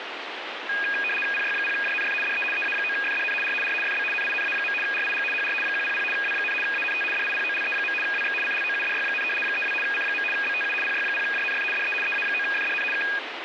RTTY (75 baud, 850 Hz shift), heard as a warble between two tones, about 2050 Hz centre, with radio static. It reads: PY0JNF DE EA9FDN R R FB NINA. RIG HR 100 W, ANT DIPOLE. WX CLOUDY, 32 C. BTU PY0JNF DE EA9FDN K